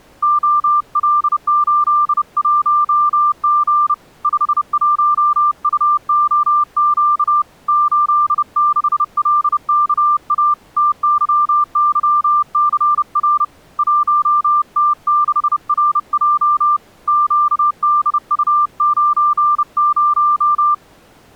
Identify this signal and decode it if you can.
Morse code, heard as a keyed tone, hand-sent with a bug key, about 30 wpm, 1190 Hz. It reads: OL81G 51UOQ 86LKA TYYCR 1T6RJ QDU90